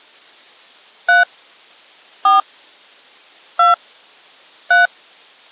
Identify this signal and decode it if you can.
DTMF, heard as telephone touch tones, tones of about 150 ms. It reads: 3 4 2 3